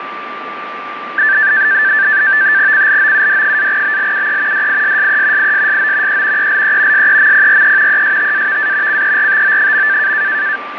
NAVTEX (SITOR-B), 100 baud, 170 Hz shift, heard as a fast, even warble, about 1650 Hz centre, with radio static and a steady whistle near 1180 Hz. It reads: CLOUD-BLUE DISSE ISSO E ELE SEMPRE ESTAVA CERTO.